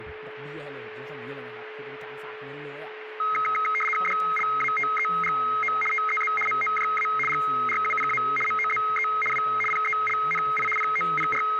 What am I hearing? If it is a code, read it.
RTTY (75 baud, 850 Hz shift), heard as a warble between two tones, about 1700 Hz centre, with radio static, a steady whistle near 430 Hz and speech in Thai. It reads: DLATEGO TEZ MOJA GRUPA MOZE W PELNI …